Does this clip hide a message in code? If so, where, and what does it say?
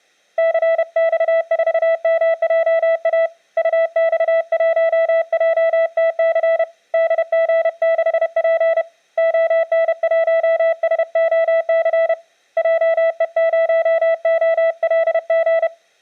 Yes: Morse code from 0.3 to 15.7 s, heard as a keyed tone, hand-sent with a paddle, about 31 wpm, 660 Hz. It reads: CX4MJA UX1JTC DG6P ON1SOC JE0OLG